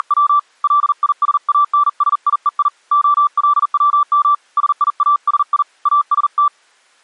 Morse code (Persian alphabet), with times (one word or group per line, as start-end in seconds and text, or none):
0.0-0.4 …
0.6-2.7 لیسانسیهی
2.9-4.3 علوم
4.6-5.6 سیاسی
5.9-6.5 است